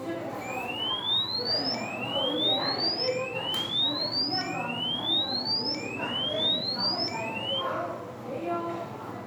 A tone that sweeps in pitch again and again, with room echo and the noise of a crowd indoors. There is no code.